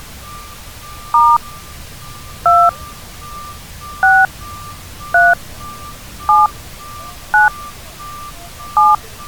DTMF, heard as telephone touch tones, dialled by hand, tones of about 180 ms, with street noise. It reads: * 2 6 3 7 9 7